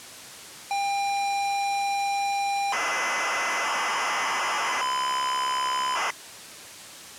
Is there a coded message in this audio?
Yes: ZX Spectrum tape loading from 0.7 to 6.1 s, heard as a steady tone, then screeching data.